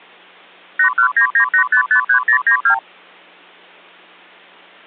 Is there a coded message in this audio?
Yes: multi-frequency trunk signalling (R2, with the far end's replies) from 0.8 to 2.8 s, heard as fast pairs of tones, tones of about 90 ms. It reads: 81998553092